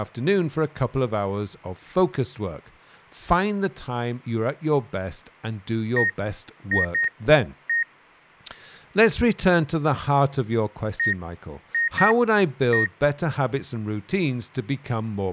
Beep code, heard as beeps from a small speaker, played twice, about 1850 Hz, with speech in English. 1-2-1. In Phoenix BIOS tables: interval timer failure.